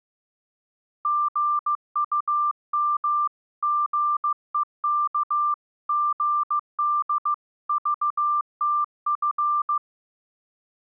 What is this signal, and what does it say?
Morse code (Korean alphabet), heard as a keyed tone, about 15 wpm, 1180 Hz. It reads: 심상스런